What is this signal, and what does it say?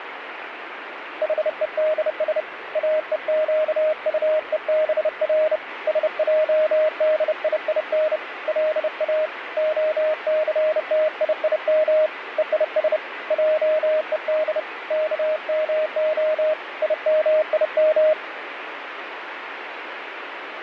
Morse code (Hebrew alphabet), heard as a keyed tone, hand-sent with a bug key, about 30 wpm, 620 Hz, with radio static. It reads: חודש אוקטובר שעדיין לא הסתיים ויש עוד כמה ימים